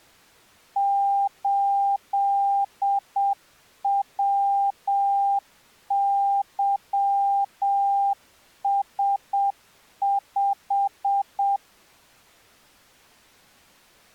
Morse code, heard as a keyed tone, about 7 wpm, 800 Hz. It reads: 8WYS5